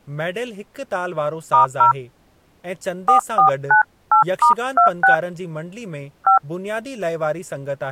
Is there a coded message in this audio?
Yes: DTMF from 1.5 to 6.4 s, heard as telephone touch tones, dialled by hand, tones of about 110 ms, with speech in Sindhi. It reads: *0 4498*26 5